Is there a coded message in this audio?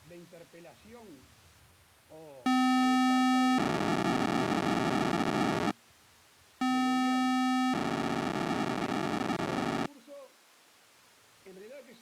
Yes: POCSAG pager data (512 baud) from 2.5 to 9.9 s, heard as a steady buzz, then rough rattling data.